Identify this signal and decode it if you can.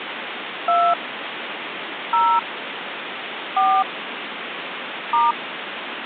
DTMF, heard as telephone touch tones, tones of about 260 ms, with phone line noise. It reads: 2 0 4 *